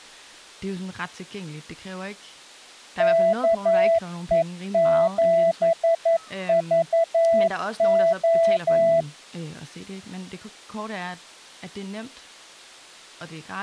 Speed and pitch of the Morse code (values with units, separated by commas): 11 wpm, 660 Hz